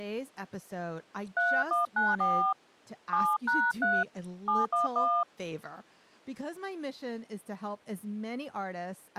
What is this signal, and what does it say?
DTMF, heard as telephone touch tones, dialled by hand, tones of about 240 ms, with speech in English. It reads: 3194 7#3 711